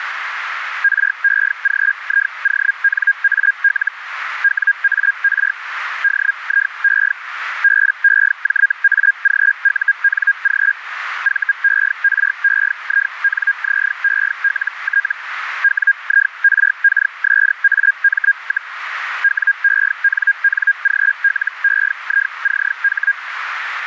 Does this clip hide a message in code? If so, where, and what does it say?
Yes: Hellschreiber (Feld-Hell, 122.5 baud) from 0.8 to 23.1 s, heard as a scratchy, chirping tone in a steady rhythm, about 1600 Hz, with radio static and a narrow filter. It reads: REGIONAL WAR DIE BEJAGUNG VEREINZELT WIRKSAM, WENNGLEICH